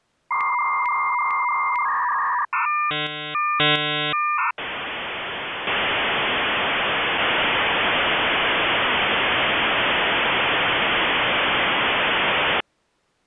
Dial-up modem handshake (V.34 or later), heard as a whistle, warbles, then hiss.